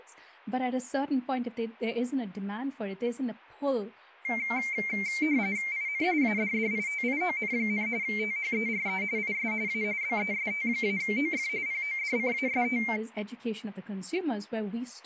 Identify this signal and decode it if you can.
RTTY (45.45 baud, 170 Hz shift), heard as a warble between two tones, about 2200 Hz centre, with speech in English. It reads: IN ADDITION, THERE IS A BEST-OF PODCAST